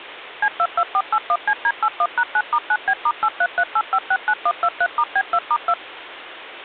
DTMF, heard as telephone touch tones, dialled by machine, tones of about 60 ms, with phone line noise. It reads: C22481CD81#9*9B*8338569123*B2*2